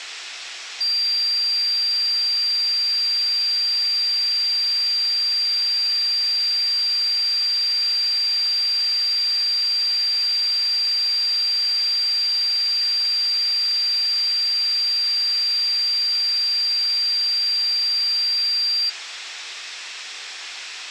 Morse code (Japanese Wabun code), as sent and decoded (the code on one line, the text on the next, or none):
none